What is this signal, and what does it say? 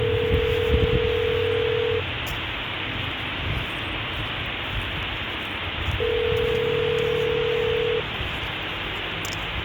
Telephone call progress tone (North American plan), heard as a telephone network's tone, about 440, 480 Hz, 2 s on and 4 s off, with phone line noise and street noise. Ringback tone.